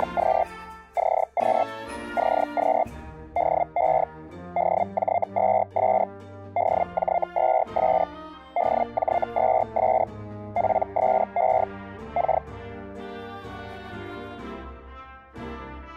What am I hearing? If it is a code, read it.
Hellschreiber (Feld-Hell, 122.5 baud), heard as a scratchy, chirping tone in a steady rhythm, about 700 Hz. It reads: … CQ CQ DE DJ2S DJ2S DJ2S PSE K